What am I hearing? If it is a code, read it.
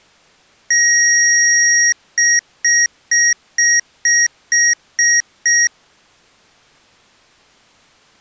Beep code, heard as beeps from a small speaker, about 1900 Hz. 1 long, 8 short. In AMI BIOS tables: display or retrace test failure.